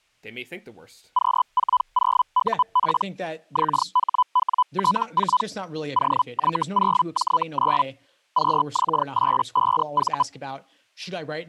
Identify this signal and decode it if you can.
Hellschreiber (Feld-Hell, 122.5 baud), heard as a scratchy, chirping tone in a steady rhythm, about 1000 Hz, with speech in English. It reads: Q40UP XHWT4 OY0J9 QX85V